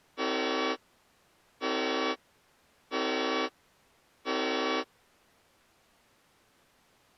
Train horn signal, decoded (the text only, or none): 4 short